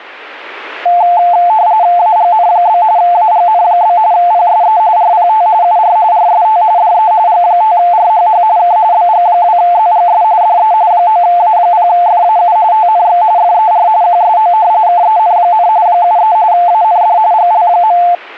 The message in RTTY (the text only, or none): AGN? AGN? PSE RPT UR RST DE G5RHH K BG2ZGS DE 9A0FAU TNX FER QSO KEN, 73 AND GL.